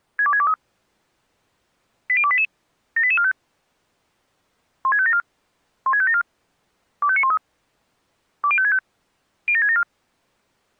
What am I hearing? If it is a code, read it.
Five-tone selective call (ZVEI), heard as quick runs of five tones, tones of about 70 ms. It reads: 62623 80288 78845 16574 16574 25913 20565 07674